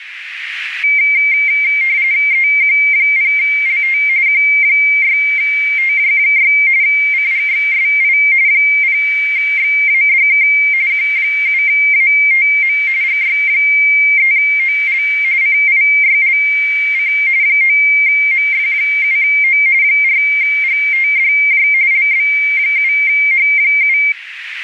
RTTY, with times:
2.3-4.0 EQ0LT
4.3-6.5 Q6TJ6
6.8-8.2 CGXSI
8.5-10.5 0XADK
10.9-12.8 Q7ATM
13.0-15.0 GY3OL
15.4-17.1 CIYLC
17.4-19.6 9MF7O
19.8-21.7 4GTDJ
21.9-24.0 LB7H7

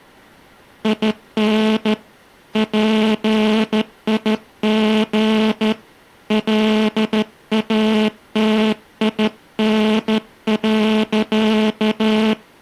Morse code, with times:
0.8-1.9 IN
2.6-5.7 PIG
6.3-12.3 LATIN.

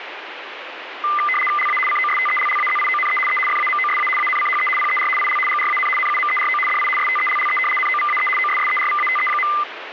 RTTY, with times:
1.6-1.8 LA
1.9-3.2 COSTELLAZIONE
3.3-3.4 E
3.5-4.1 FAMOSA
4.2-4.7 ANCHE
4.8-5.1 PER
5.2-5.4 IL
5.5-5.9 GRAN
6.0-6.6 NUMERO
6.7-6.9 DI
7.0-7.6 STELLE
7.8-8.3 NOVAE
8.4-9.5 OSSERVATE.

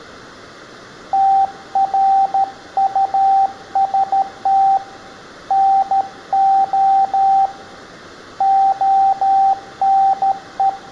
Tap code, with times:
none

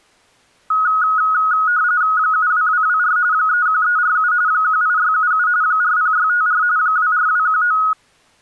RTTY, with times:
2.2-3.2 72224
3.3-4.3 31347
4.5-5.5 18677
5.6-6.6 40654
6.8-7.8 24219

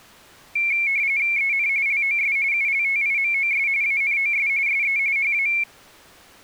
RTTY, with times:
1.4-1.7 EN
1.9-2.4 LOS
2.5-3.7 ULTIMOS
3.8-4.5 ANOS
4.7-5.0 SE
5.2-5.5 HA

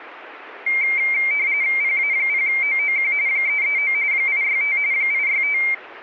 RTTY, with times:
1.8-3.1 PA0OOQ
3.3-3.9 339
4.1-4.8 865
4.9-5.6 865

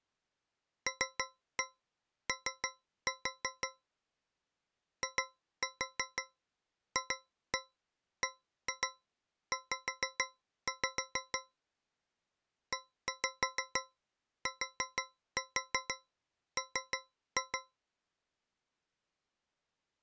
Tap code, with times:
0.9-3.7 LO
5.0-11.4 IFBZ
12.7-17.6 ETM

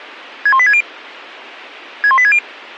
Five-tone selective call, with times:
0.5-0.8 61860
2.0-2.4 61860

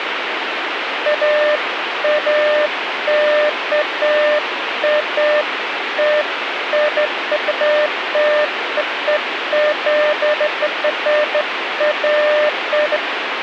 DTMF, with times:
none

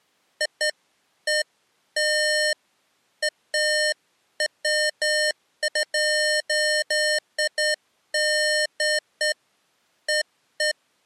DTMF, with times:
none

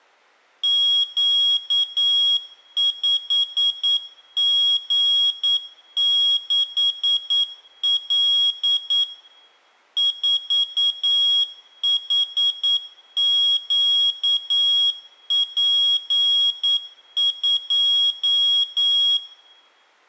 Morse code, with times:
0.6-9.0 Q5G6L
10.0-19.2 4HQP2

